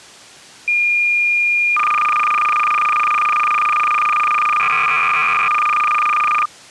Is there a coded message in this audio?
Yes: cassette data (Kansas City type), 300 baud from 0.7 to 6.5 s, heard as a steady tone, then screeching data.